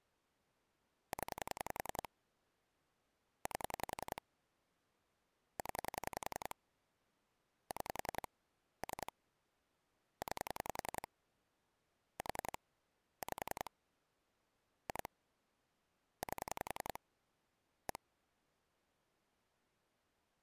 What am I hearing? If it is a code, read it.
Pulse dialling, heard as clicks on a phone line, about 10 pulses a second. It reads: 0 8 0 6 3 9 4 5 2 8 1